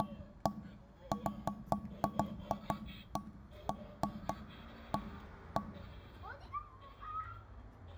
Irregular knocks on wood, with room echo and the noise of a residential street. There is no code.